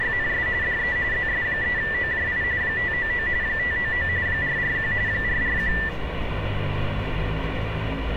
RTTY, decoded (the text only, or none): … DE ZS3OJI 599 599 441 441